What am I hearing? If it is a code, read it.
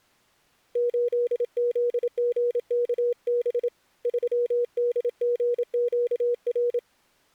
Morse code, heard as a keyed tone, hand-sent with a paddle, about 27 wpm, 480 Hz. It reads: 8ZGKB 3DGQR